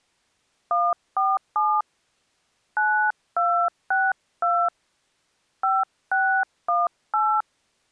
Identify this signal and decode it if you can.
DTMF, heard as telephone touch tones, dialled by hand, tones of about 260 ms. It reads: 147 9262 5618